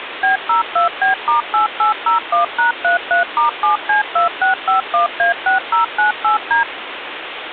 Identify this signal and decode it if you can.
DTMF, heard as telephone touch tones, dialled by machine, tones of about 130 ms, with phone line noise. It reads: B02B*8801#33*7C2651A6098D